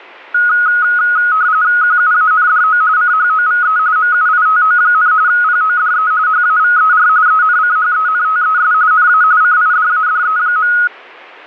RTTY (45.45 baud, 170 Hz shift), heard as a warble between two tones, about 1360 Hz centre. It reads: QUANDO CHOVE MUITO, PODE HAVER ENCHENTES NA CIDADE.